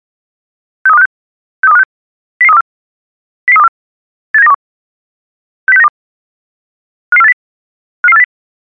Five-tone selective call (EEA), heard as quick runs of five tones, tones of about 40 ms. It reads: 63256 63256 00324 00324 87921 60692 55480 55480